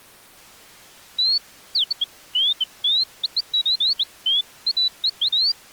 Bird-like chirps. There is no code.